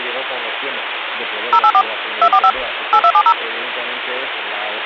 DTMF, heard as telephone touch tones, dialled by machine, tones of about 70 ms, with phone line noise. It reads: 084 245 8270